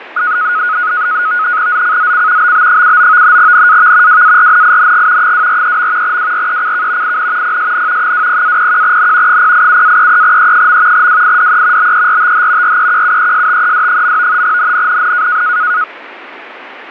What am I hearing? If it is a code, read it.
NAVTEX (SITOR-B), 100 baud, 170 Hz shift, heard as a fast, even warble, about 1360 Hz centre, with radio static. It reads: ZCZC BB79 NAV WARNING 243. WRECK IN PSN 20-01N 087-33E. WIDE BERTH REQUESTED. NNNN